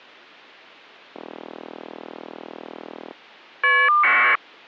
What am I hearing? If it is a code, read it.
Caller ID data burst, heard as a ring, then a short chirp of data, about 1200 baud.